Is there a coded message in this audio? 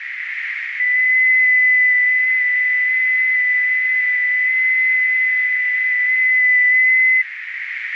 Yes: FT8 (one signal) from 0.8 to 7.2 s, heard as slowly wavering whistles, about 6.25 baud, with heavy radio static and a narrow filter.